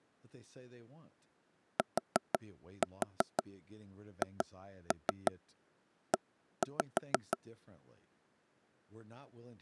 Tap code, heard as taps on a table, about 6 knocks a second, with speech in English. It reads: THE